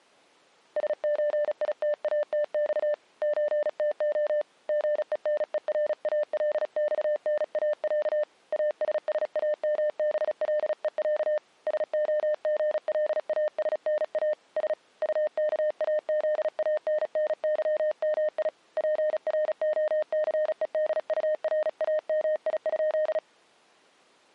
Morse code (Russian alphabet), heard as a keyed tone, hand-sent with a paddle, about 36 wpm, 600 Hz. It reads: СЧИТАТЬ ЧТО ГЕНЕРАЛЬНАЯ АССАМБЛЕЯ СОГЛАСНА С УКАЗАННЫМИ ПРОЦЕДУРАМИ?